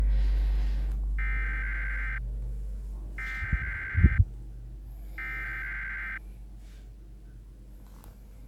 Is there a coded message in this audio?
Yes: Emergency Alert System (SAME) tones (header bursts) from 1.2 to 6.2 s, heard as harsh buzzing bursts, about 520.83 baud, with the noise inside a lift.